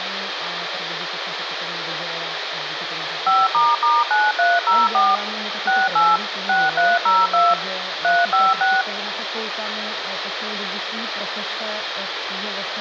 DTMF, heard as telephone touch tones, dialled by machine, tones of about 200 ms, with radio hiss. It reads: 5**9304 68 6302 356